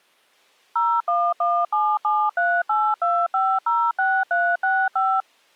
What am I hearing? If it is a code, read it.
DTMF, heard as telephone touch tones, dialled by machine, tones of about 250 ms. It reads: 01177382506365